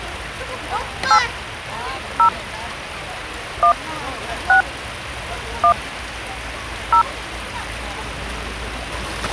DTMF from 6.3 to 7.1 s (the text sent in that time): 0